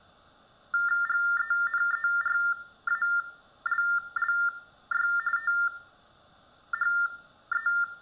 TTY/TDD text telephone tones (45.45 baud Baudot), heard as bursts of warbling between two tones, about 400 Hz shift, 1600 Hz centre, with room echo. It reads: GENERALLY THE